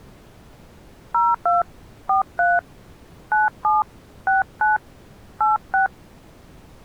DTMF, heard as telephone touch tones, dialled by hand, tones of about 170 ms. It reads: 02 43 97 69 86